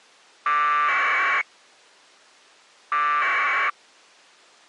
Packet radio (AX.25, as in APRS), 1200 baud, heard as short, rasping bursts.